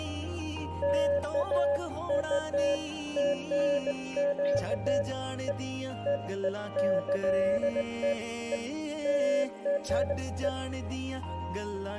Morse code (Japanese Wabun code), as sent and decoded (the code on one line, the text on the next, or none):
none